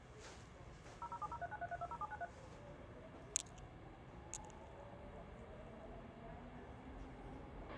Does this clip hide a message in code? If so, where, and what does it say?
Yes: DTMF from 1.0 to 2.2 s, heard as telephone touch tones, dialled by machine, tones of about 40 ms, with radio hiss, a squelch burst at the end and the noise inside a subway train. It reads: 0070393320793